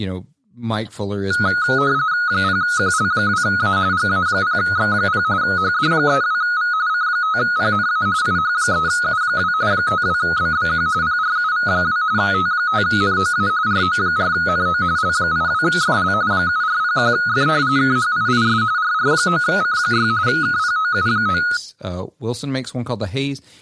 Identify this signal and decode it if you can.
RTTY (45.45 baud, 170 Hz shift), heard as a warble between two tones, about 1360 Hz centre, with speech in English. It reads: 0QL2A GA0X0 HD32V C5PNA IH3U2 52BBQ PRUV2 T5NOA RO4NO L82FL 7401F KHIIS RR9C6 KPOU9